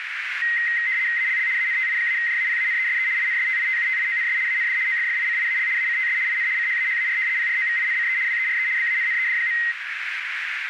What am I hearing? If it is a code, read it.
RTTY (75 baud, 170 Hz shift), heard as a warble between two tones, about 1950 Hz centre, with radio static and a narrow filter. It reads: ALL ANTI-JAPANESE INSTITUTIONS AND OFFICIAL ACTS IN CHAHAR PROVINCE WERE BANNED.